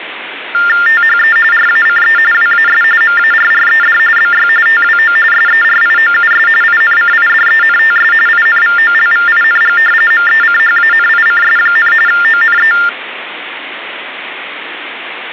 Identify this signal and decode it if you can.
TTY/TDD text telephone tones (45.45 baud Baudot), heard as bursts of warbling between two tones, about 400 Hz shift, 1600 Hz centre, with phone line noise. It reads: THE RACE WAS MARRED BY TWO SERIOUS INCIDENTS INVOLVING MECHANICS, ONE